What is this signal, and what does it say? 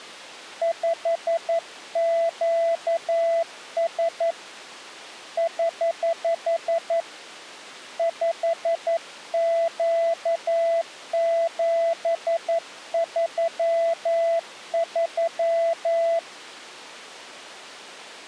Morse code, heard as a keyed tone, hand-sent with a paddle, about 11 wpm, 670 Hz. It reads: 5QS <HH> 5Q733